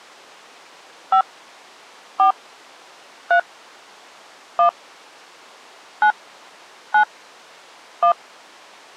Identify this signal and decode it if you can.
DTMF, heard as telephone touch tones, dialled by hand, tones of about 100 ms. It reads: 5 4 3 1 9 9 1